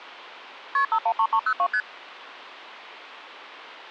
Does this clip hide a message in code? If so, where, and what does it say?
Yes: multi-frequency trunk signalling (R1, as on North American trunks) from 0.7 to 1.8 s, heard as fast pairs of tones, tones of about 70 ms. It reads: KP 513302 ST